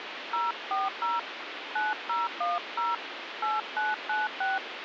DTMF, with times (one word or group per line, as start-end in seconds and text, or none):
0.3-1.2 040
1.8-2.9 9010
3.4-4.6 8996